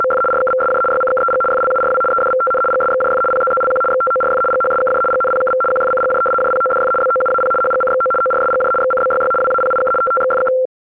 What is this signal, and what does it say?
RTTY (75 baud, 850 Hz shift), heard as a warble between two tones, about 940 Hz centre. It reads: … RKVSJ YCKEG FLURW EDVTN GSXJF PZZLQ XTORF GHSKJ GNPKV QFCGJ JPODF BOUAP HGCXO ORSGJ XCBYY WAPIK TTXFK